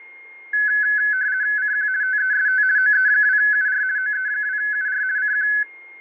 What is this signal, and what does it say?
RTTY (50 baud, 170 Hz shift), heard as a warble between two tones, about 1600 Hz centre, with a steady whistle near 2130 Hz. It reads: CQ TEST OE2UR OE2UR CQ